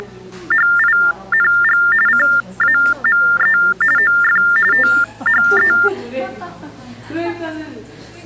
TTY/TDD text telephone tones (45.45 baud Baudot), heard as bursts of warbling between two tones, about 400 Hz shift, 1600 Hz centre, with the noise of a cafe. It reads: … CAME OF THE